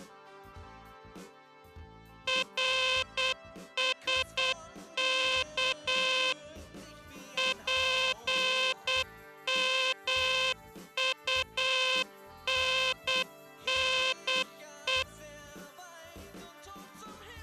Morse code, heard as a buzzer, machine-sent, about 8 wpm. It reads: RSK PMUNNE